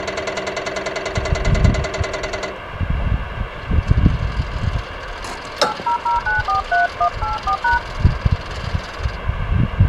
DTMF, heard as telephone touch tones, dialled by hand, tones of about 120 ms, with phone line noise. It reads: 800943184#